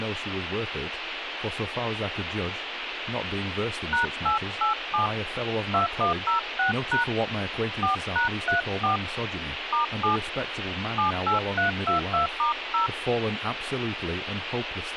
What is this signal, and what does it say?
DTMF, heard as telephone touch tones, dialled by hand, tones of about 130 ms, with phone line noise and speech in English. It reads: #887 2106# 4#34 *7 78322*0